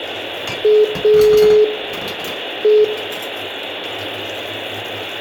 Telephone call progress tone (pulsed, as in Italy), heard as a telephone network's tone, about 420 Hz, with phone line noise, room echo and kitchen noise. Dial tone.